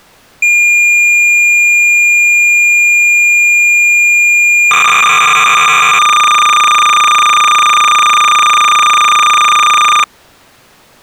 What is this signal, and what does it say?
Cassette data (Kansas City type), 300 baud, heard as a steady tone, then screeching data.